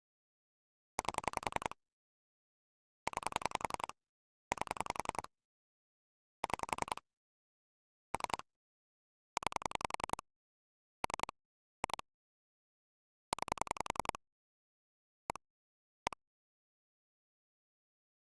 Pulse dialling, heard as clicks on a phone line, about 10 pulses a second. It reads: 8 9 8 6 3 9 3 2 9 1 1